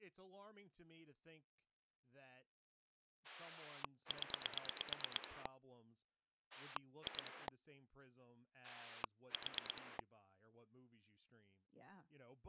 Pulse dialling, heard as a rotary dial, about 8 pulses a second, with speech in English. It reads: 0 2 4